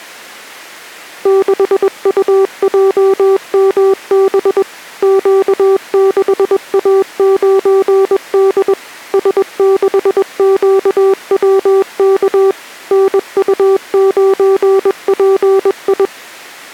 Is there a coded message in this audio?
Yes: Morse code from 1.2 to 16.1 s, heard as a keyed tone, machine-sent, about 21 wpm, 390 Hz. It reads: 6UJMB Q6A9D S6QWK NU9PI